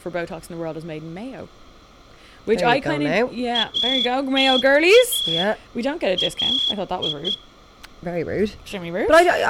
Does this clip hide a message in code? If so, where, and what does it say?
Yes: Morse code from 3.5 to 7.4 s, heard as a whistle, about 12 wpm, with room echo and speech in English. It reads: ATA AI